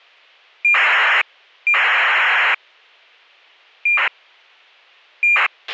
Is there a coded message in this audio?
Yes: ACARS aircraft data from 0.6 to 5.5 s, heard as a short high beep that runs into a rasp, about 2400 baud, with a squelch burst at the end.